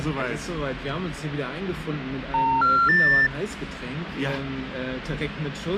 Telephone call progress tone (North American plan), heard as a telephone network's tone, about 910, 1370, 1800 Hz. Special information tone.